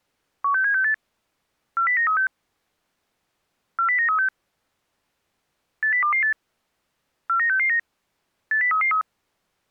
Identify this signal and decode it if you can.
Five-tone selective call (CCIR), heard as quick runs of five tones, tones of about 100 ms. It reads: 16768 40936 40936 80228 49669 80333